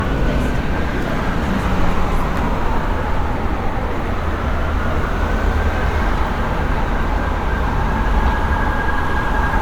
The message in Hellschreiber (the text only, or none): none